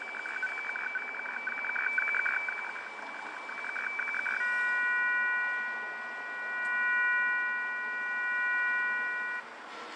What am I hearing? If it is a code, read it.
Weather fax (radiofax), 120 lines a minute, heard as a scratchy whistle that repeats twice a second, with radio static, fading, room echo and street noise.